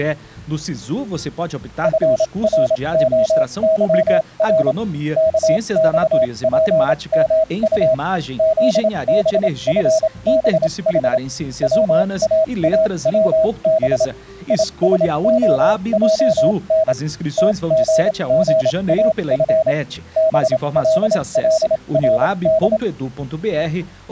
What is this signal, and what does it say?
Morse code, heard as a keyed tone, machine-sent, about 27 wpm, spaced as for 23 wpm, 640 Hz. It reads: FROYR KXPMU ZBFBH WAAWB ISOJN TGGAF BLLRD